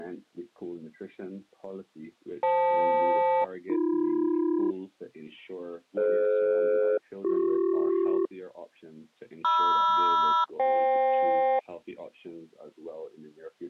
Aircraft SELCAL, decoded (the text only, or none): FL-AB DF-BC MR-FK